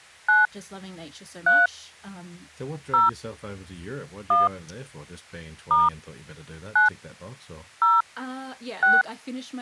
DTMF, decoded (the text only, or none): 9 3 0 1 * 9 0 6